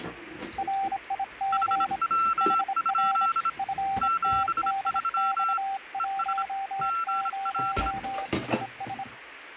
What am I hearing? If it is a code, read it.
Morse code, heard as two keyed tones, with radio static and kitchen noise. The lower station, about 26 wpm, 780 Hz: RIG HR FTDX10 ES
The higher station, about 26 wpm, 1350 Hz: HW? 73 ES GL